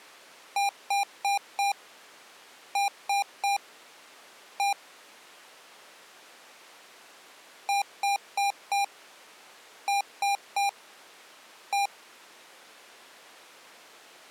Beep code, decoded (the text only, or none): 4-3-1